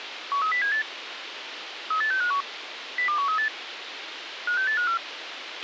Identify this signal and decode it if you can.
Five-tone selective call (CCIR), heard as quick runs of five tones, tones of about 100 ms, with radio hiss and a squelch burst at the end. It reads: 13078 38651 02138 56854